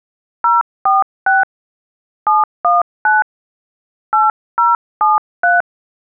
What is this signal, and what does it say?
DTMF, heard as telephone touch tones, dialled by hand, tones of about 170 ms. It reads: 046 719 8073